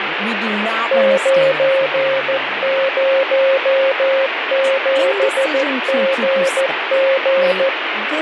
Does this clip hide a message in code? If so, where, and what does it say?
Yes: Morse code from 0.9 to 7.7 s, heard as a keyed tone, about 14 wpm, 540 Hz, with radio static and speech in English. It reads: 907GG